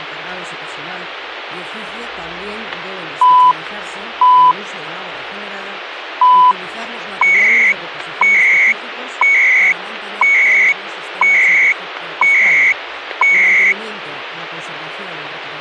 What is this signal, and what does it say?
Radio time signal (CHU, Canada), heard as beeps and data bursts, one a second, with radio static.